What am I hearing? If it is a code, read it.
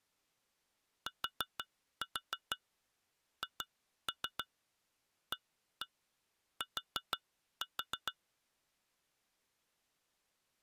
Tap code, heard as taps on glass, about 6 knocks a second. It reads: THAT